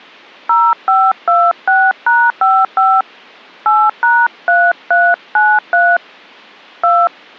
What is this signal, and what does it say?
DTMF, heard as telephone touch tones, dialled by hand, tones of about 240 ms. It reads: 0526#55 8#3393 2